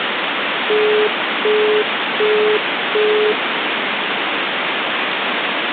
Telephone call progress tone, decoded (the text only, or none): busy tone